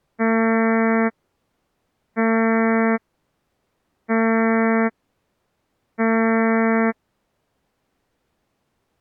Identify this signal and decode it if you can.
Ship horn signal, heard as a ship's horn, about 220 Hz. 4 short. At sea: a pilot vessel's identity signal in fog.